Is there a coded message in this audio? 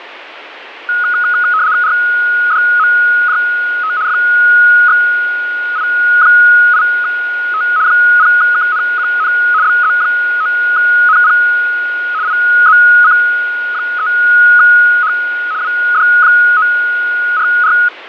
Yes: RTTY (75 baud, 170 Hz shift) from 0.9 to 17.9 s, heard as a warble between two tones, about 1360 Hz centre, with radio static and fading. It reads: RDMJT FXI8T 0KNQN BZ9NP IZC3H WD944